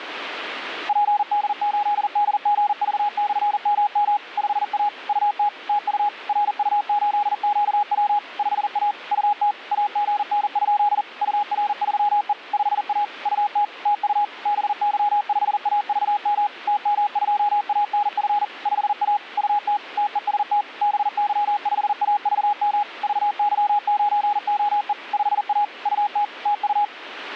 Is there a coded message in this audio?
Yes: Morse code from 0.8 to 26.9 s, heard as a keyed tone, machine-sent, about 40 wpm, 830 Hz. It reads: PD8DGV/MM 5A UT TU RU8QW 5A UT AGN? UR3E 5A UT TU BY5AVM TM2ANF 5A UT TEST BY5AVM VY9OE 5A UT TU